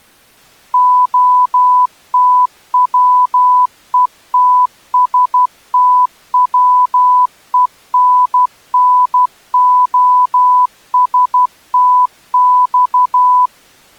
Morse code (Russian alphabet), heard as a keyed tone, machine-sent, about 12 wpm, 1000 Hz. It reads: ОТВЕТСТВЕННОСТЬ